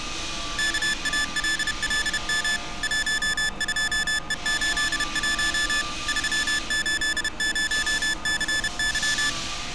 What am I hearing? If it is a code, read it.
Morse code, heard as electronic beeps, machine-sent, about 31 wpm, 1750 Hz, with street noise. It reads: KALLM 12E81 380CY